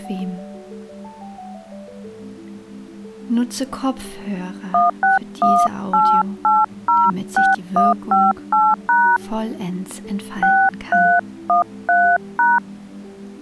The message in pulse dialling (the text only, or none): none